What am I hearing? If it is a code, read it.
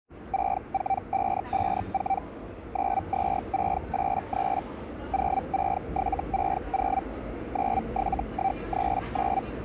Hellschreiber (Feld-Hell, 122.5 baud), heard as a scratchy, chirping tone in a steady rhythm, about 780 Hz, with the noise of a subway station. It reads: 64554 92683 06760 97139